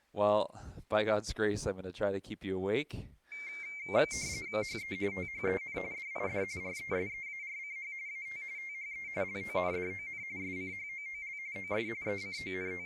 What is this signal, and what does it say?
RTTY (45.45 baud, 170 Hz shift), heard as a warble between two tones, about 2200 Hz centre. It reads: HE THEN DID RESEARCH AT THE LONDON SCHOOL OF …